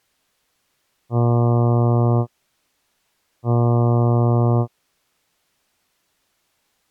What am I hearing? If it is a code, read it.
Ship horn signal, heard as a ship's horn, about 120 Hz. 2 short. At sea: I am altering course to port.